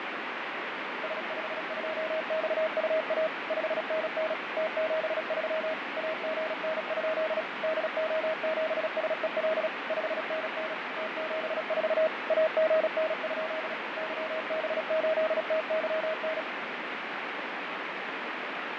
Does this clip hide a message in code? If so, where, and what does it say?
Yes: Morse code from 1.0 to 16.5 s, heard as a keyed tone, machine-sent, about 36 wpm, 630 Hz, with heavy radio static and fading. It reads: S52XUA 5NN T73 AGN? DO7SEL 5NN T74 AGN? YB8TYN